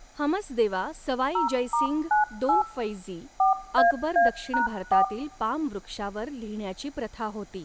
DTMF, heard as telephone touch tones, dialled by machine, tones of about 130 ms, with room echo and speech in Marathi. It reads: 0*98 4AA#4